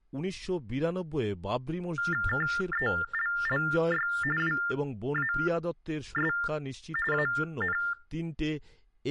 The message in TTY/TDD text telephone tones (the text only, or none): KELLY WAS AN